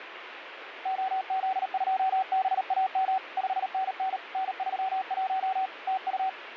Morse code, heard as a keyed tone, hand-sent with a paddle, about 38 wpm, 760 Hz, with radio static. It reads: OZ2BAM 5NN N31 TU